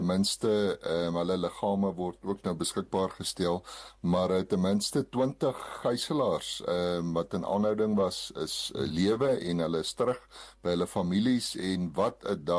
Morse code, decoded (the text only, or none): none